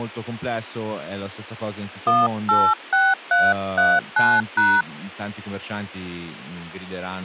DTMF, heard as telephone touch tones, dialled by hand, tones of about 230 ms, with speech in Italian. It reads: 186339#